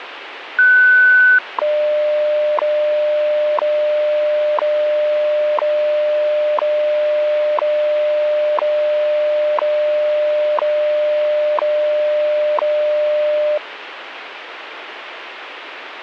Radio time signal (WWV, Colorado), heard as ticks, one a second, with radio static.